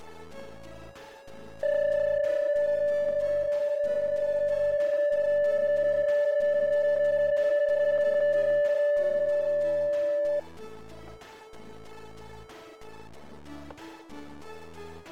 PSK31 (31.25 baud), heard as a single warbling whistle, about 580 Hz, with static crashes.